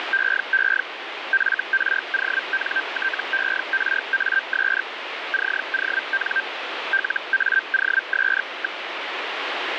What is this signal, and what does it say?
Hellschreiber (Feld-Hell, 122.5 baud), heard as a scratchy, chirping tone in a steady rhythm, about 1550 Hz, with radio static. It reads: … FRONTERAS CON LAOS.